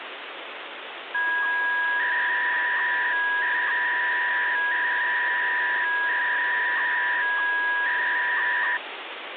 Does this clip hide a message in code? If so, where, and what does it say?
Yes: 300-baud modem data (V.21 tones) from 1.1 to 8.8 s, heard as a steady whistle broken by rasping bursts, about 300 baud, 200 Hz shift, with phone line noise.